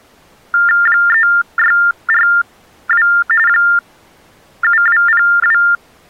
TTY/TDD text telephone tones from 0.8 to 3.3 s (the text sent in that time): 3642